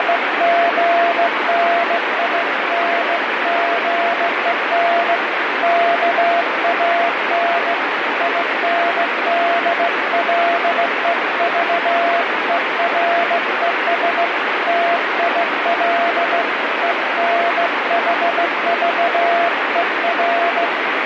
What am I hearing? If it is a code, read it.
Morse code (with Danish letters), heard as a keyed tone, hand-sent with a straight key, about 16 wpm, 690 Hz, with heavy radio static. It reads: … KAN INDLEVERES TIL ENHVER